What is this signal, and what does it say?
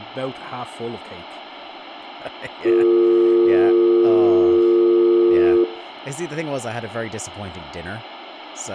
Telephone call progress tone (North American or UK plan), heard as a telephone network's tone, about 350, 450 Hz, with room echo and speech in English. Dial tone.